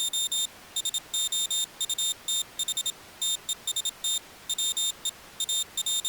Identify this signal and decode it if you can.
Morse code, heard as a high beeper, hand-sent with a paddle, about 27 wpm, 3650 Hz. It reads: … SOUTH TEST WE …